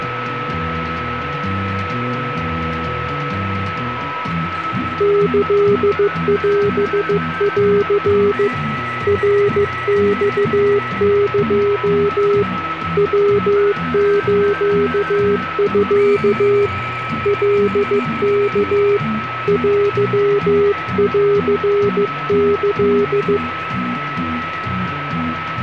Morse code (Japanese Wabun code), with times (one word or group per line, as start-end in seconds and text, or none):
5.0-8.5 キオン
9.1-12.4 ナマエ
13.0-16.7 ヤスミ
17.3-19.0 カワ
19.5-23.4 テンキ